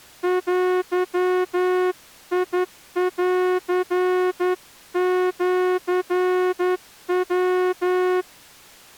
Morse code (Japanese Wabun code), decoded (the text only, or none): デンシヤ